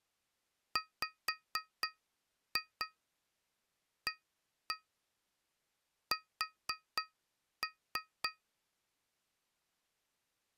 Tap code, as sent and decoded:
5-2 1-1 4-3
WAS

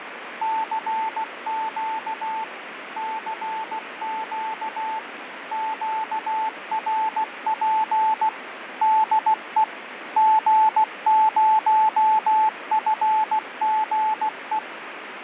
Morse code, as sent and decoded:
-.-. --.- / -.-. --.- / --.- .-. .--. / -.. . / --. ----- ..-. --. .
CQ CQ QRP DE G0FGE

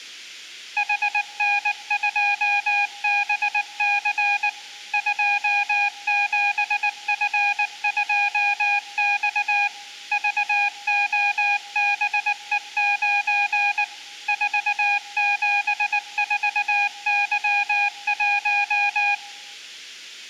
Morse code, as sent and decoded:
.... -. ..--- -... -.-. / ..--- --... ..-. ..--- -..- / ...- --- -... . ----. / ....- --... ....- -.-- .----
HN2BC 27F2X VOBE9 474Y1

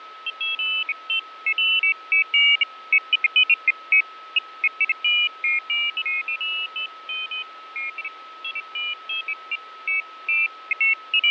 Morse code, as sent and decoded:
none

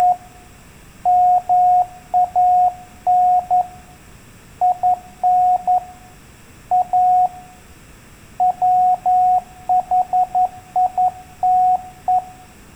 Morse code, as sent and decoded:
… / -- .- -. / .. -. / .- / .-- .... .. - .
… MAN IN A WHITE

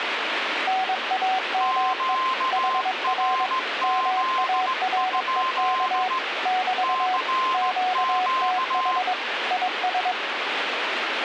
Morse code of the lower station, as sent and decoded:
-. .- -- . / .... .-. / -- .- .-. . -.- / -...- / --.- - .... / .. ...
NAME HR MAREK <BT> QTH IS

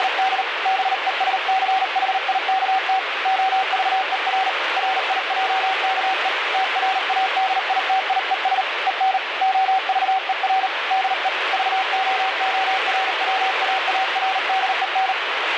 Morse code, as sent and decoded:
… / -... . ... -.-. .... .. -.- - / --- ...- . .-. / .-. .. .--- -.- . / - .-. .- -.. .. - .. . ... / . -. / --- ...- . .-. / -.. . / ...- --- --- .-. .-- .- .- .-. -.. . -.
… BESCHIKT OVER RIJKE TRADITIES EN OVER DE VOORWAARDEN

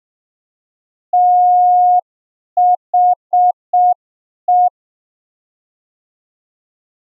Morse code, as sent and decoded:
- .... .
THE

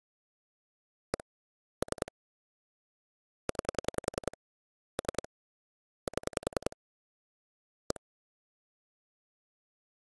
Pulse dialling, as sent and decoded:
1 / 3 / 9 / 3 / 7 / 1
1 3 9 3 7 1

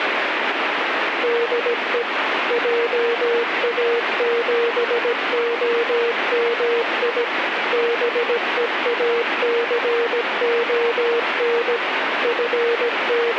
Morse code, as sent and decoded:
-.. . / .--- .- --... --- -- .. / -... . .- -.-. --- -. / …
DE JA7OMI BEACON …

